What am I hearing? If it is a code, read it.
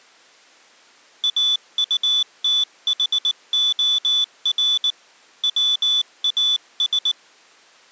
Morse code, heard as a high beeper, hand-sent with a paddle, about 19 wpm, 3500 Hz. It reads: AUTHOR WAS